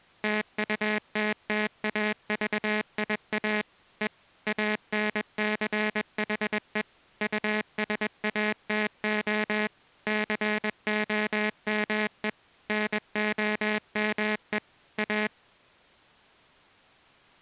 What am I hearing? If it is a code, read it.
Morse code, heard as a buzzer, machine-sent, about 21 wpm. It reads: TUTTAVIA E ANCHE USATO COME NOME A